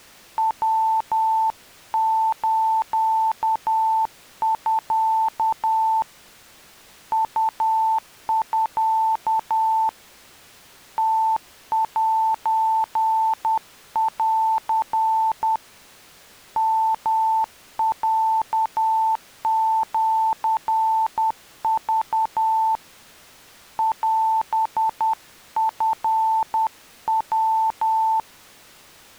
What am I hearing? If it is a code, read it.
Morse code (Japanese Wabun code), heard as a keyed tone, hand-sent with a paddle, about 10 wpm, 890 Hz. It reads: ヤスミ ウミ ムセン ヨロシク オチヤ